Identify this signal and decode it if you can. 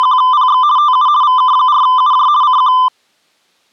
RTTY (50 baud, 170 Hz shift), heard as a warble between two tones, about 1100 Hz centre. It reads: … TU VK4UJ CQ